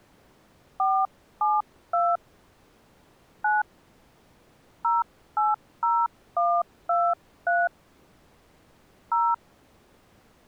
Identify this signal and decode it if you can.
DTMF, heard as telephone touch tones, dialled by hand, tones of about 220 ms. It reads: 472 9 080123 0